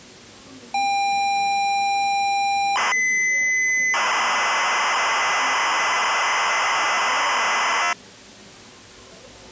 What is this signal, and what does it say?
ZX Spectrum tape loading, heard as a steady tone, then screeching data, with the noise of a cafe.